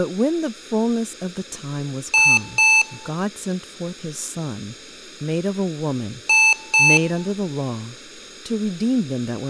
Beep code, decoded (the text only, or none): 2 short